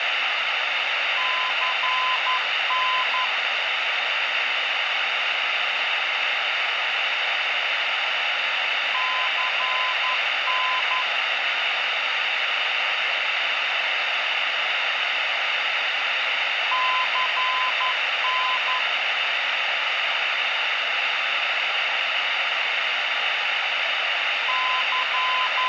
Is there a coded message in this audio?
Yes: Morse code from 1.1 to 25.7 s, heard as a keyed tone, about 11 wpm, 1020 Hz, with radio static. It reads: CN CN CN …